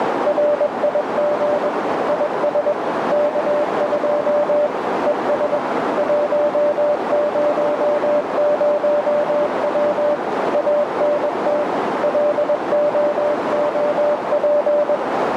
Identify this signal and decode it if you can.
Morse code, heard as a keyed tone, machine-sent, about 21 wpm, 590 Hz, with heavy radio static and a narrow filter. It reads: RIG IS K2 ES 100W ANT LOOP